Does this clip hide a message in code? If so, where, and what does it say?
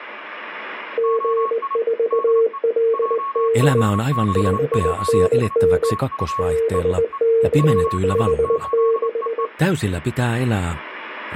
Yes: Morse code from 0.9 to 9.5 s, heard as a keyed tone, hand-sent with a straight key, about 20 wpm, 450 Hz, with a weaker station near 1100 Hz. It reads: G4LD 5NN BK56